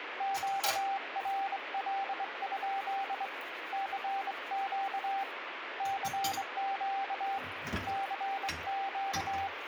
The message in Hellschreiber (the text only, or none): none